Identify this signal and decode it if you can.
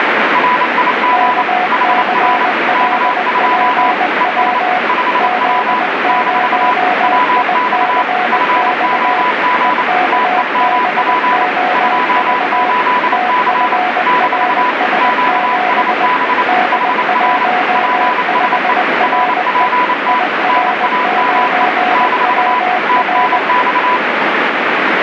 Morse code, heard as two keyed tones, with heavy radio static. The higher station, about 28 wpm, 990 Hz: RIG HR K2 ES 5W - WX FOG TEMP 28C - QSB HR PSE RPT NAME - TNX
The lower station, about 20 wpm, 730 Hz: KCLPW Z0ICX EKBOV TFRS7 D15RE IR9WR